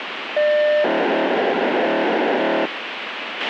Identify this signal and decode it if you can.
POCSAG pager data (1200 baud), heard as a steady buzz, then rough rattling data, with radio hiss and a squelch burst at the end.